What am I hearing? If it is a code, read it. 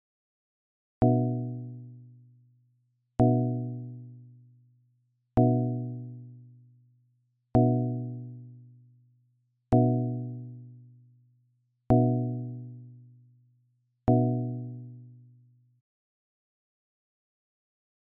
Clock strike, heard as a bell. 7. Seven o'clock.